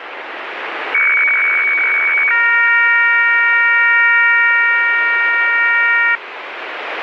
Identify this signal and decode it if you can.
Weather fax (radiofax), 120 lines a minute, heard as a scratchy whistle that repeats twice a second, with radio static.